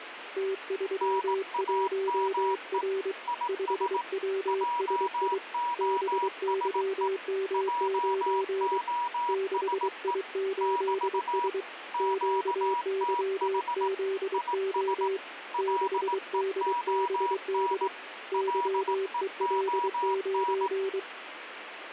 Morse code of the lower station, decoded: T31R 5WSI BYM9 6I8S QYZO 6DBD YEL9

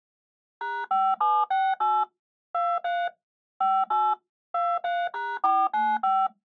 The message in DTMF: #5768 23 58 23#495

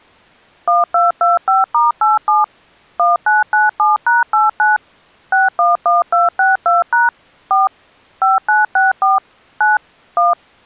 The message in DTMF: 1225*87 1997#89 611262# 4 5964 9 1

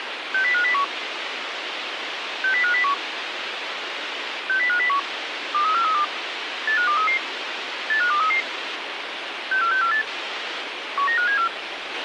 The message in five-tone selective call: 60501 60501 60501 23432 85233 85233 64648 19574

